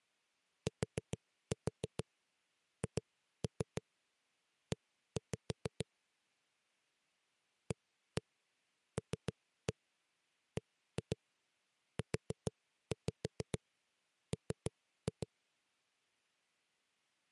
Tap code, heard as knocks on a wall, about 6 knocks a second. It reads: THE ALBUM